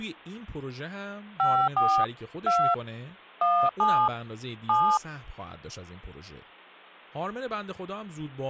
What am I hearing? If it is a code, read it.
DTMF, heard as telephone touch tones, dialled by hand, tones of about 280 ms, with speech in Persian. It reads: 54 2 17 7